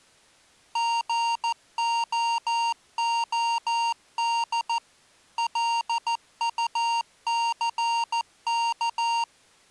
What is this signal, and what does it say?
Morse code, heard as electronic beeps, machine-sent, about 14 wpm, 930 Hz. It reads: GOOD LUCK